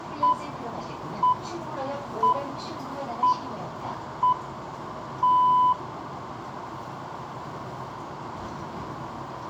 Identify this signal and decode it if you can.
Radio time signal (six pips, as the Greenwich Time Signal), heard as pips, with radio static and the noise inside a subway train.